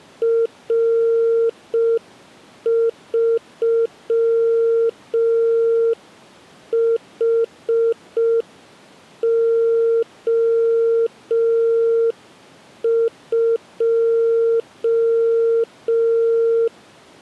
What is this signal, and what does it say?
Morse code, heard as a keyed tone, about 5 wpm, 460 Hz. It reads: R3HO2